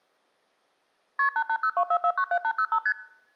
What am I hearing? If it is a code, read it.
Multi-frequency trunk signalling (R1, as on North American trunks), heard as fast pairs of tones, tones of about 70 ms. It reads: KP 88024497805 ST